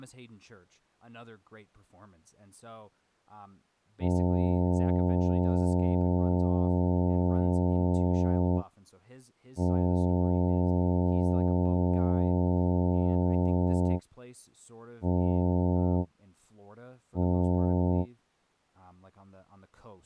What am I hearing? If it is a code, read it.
Ship horn signal, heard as a ship's horn, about 90 Hz, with speech in English. 2 long, 2 short. At sea: I intend to overtake on your port side.